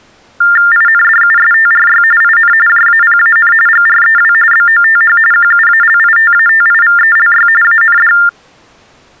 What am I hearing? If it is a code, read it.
TTY/TDD text telephone tones (45.45 baud Baudot), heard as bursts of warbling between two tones, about 400 Hz shift, 1600 Hz centre. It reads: INDUSTRY IN JAPAN GREW BOTH QUALITATIVELY AND